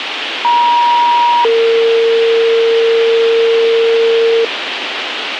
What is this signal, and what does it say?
Two-tone page, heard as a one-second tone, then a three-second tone, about 950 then 460 Hz, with radio hiss.